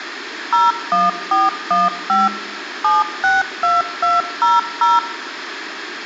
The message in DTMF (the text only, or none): 01415 762200